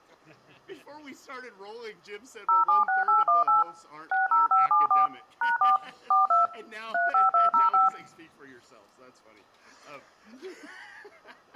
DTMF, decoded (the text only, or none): 076818 60574 #4 42 35205